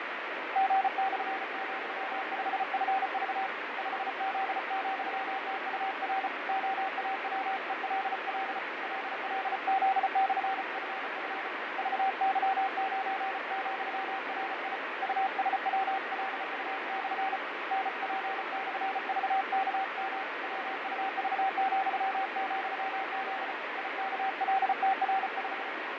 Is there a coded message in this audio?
Yes: Morse code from 0.5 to 25.7 s, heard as a keyed tone, hand-sent with a paddle, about 34 wpm, 770 Hz, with heavy radio static and fading. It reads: G/,5FV 5Z,TUR OAWELL LLZ/FF VY9,RI USWLU/ NP/VKM WUV,,Z IKLTR5